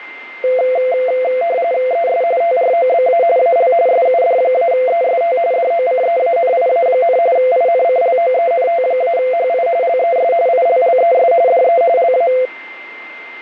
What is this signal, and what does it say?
RTTY (45.45 baud, 170 Hz shift), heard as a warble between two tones, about 600 Hz centre, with a steady whistle near 2090 Hz. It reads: ES TROBA AL SUD-EST DOCEANIA, INCLOENT-HI LES ILLES DE LA